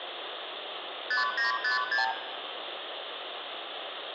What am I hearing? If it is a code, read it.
Multi-frequency trunk signalling (R2, with the far end's replies), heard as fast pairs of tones, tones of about 140 ms, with phone line noise and room echo. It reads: 5956